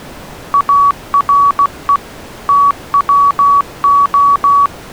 Morse code, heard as a keyed tone, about 16 wpm, 1130 Hz. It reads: ARE TWO